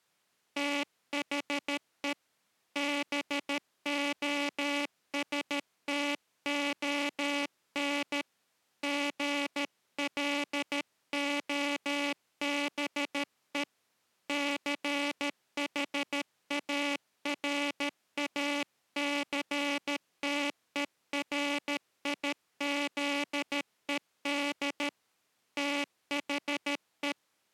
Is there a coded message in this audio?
Yes: Morse code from 0.5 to 27.2 s, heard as a buzzer, hand-sent with a paddle, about 13 wpm. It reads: THE BOSTON GLOBE CHARACTERIZED THE